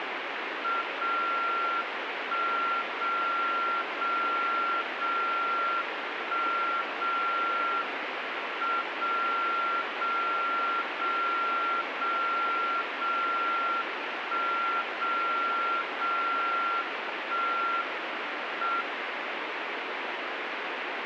Radio time signal (WWVB), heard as a tone whose level steps once a second, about 1370 Hz, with radio static. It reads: 0 1 0 0 0 1 0 M 0 0 0 0 0 1 0 0 1 M